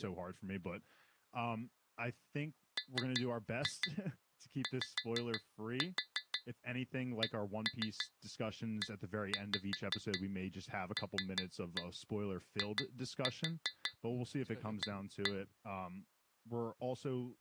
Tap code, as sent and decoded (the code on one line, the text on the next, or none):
3-2 5-4 1-3 1-5 3-1 2-4 1-1
MYCELIA